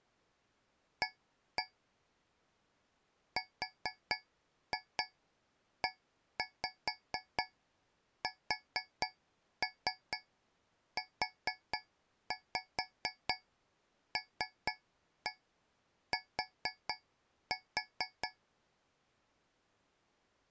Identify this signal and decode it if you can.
Tap code, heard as taps on a metal pipe, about 4 knocks a second. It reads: A RESULT